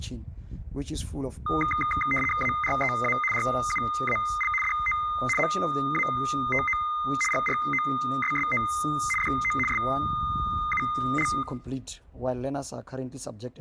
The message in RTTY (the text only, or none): AREA RUAL DO MATO GROSSO DO SUL